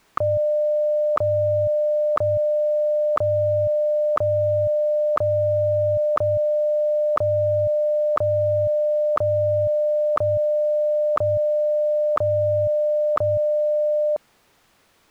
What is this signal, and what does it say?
Radio time signal (WWVH, Hawaii), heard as ticks, one a second.